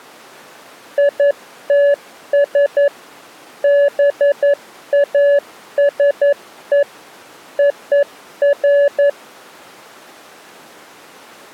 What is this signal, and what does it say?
Morse code (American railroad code), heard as a keyed tone, machine-sent, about 570 Hz. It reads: ITS BASE OF